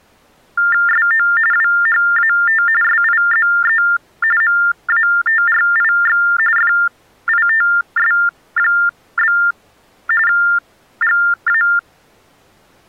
TTY/TDD text telephone tones (45.45 baud Baudot), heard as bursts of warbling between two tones, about 400 Hz shift, 1600 Hz centre. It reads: SO WHAT SIZE MATRIX FITS? GA